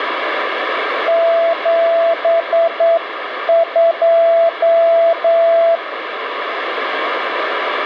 Morse code, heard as a keyed tone, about 9 wpm, 670 Hz, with radio static. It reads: 72